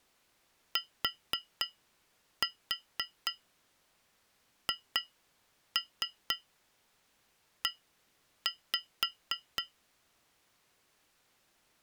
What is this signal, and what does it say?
Tap code, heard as taps on glass, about 4 knocks a second. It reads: THE